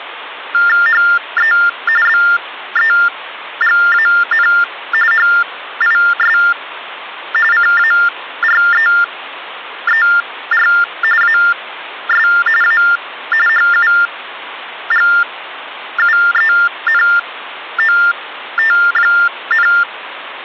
TTY/TDD text telephone tones (45.45 baud Baudot), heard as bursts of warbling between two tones, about 400 Hz shift, 1600 Hz centre, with phone line noise. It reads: HE BEGAN HIS CAREER AS A HUGUENOT,